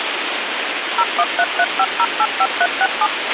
DTMF, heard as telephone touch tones, dialled by machine, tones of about 50 ms, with radio hiss and a squelch burst at the end. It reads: 01335085367